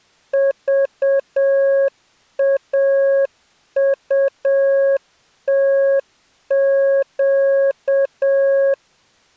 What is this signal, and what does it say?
Morse code, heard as a keyed tone, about 7 wpm, 550 Hz. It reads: VAUTQ